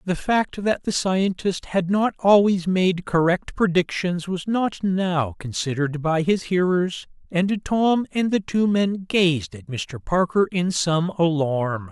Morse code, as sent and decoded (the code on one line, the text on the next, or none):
none